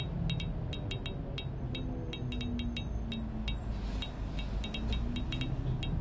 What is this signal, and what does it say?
Irregular taps on glass, with the noise inside a bus. There is no code.